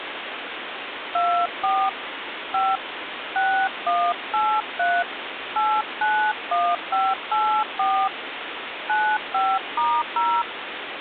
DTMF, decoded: 24 5 6183 891584 95*0

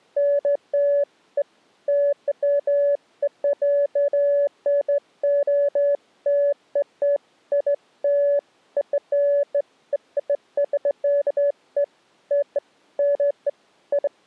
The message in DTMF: none

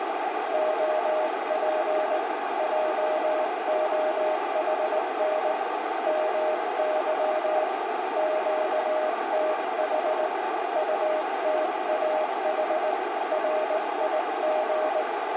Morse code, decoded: OP JOHN MY QTH UTAH RIG

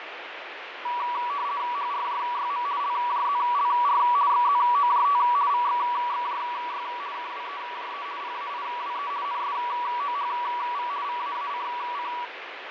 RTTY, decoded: HRJYM LJZLR XZOJT VXXJY KWEJE PAIWE NSOHV VAACC

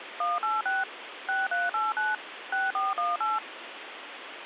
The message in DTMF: 186 6389 6418

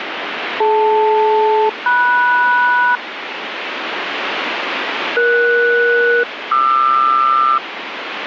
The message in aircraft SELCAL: DL-MS ES-QR

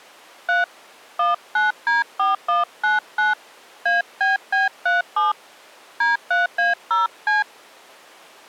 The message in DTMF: 3 19D4199 ABB37 D3A0C

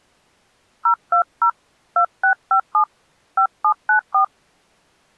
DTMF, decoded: 020 2657 5794

